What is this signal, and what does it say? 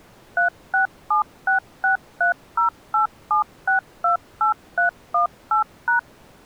DTMF, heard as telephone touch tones, dialled by machine, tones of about 120 ms. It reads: 367663087628318#